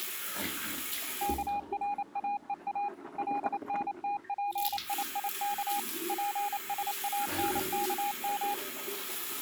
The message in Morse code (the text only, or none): KRAEA LNTPIIK PSANKM